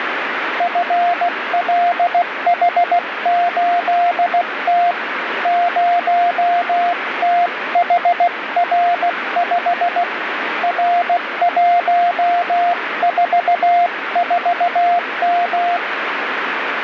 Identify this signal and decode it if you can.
Morse code, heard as a keyed tone, hand-sent with a paddle, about 16 wpm, 700 Hz, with radio static. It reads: FLH8T 0THR5 R144M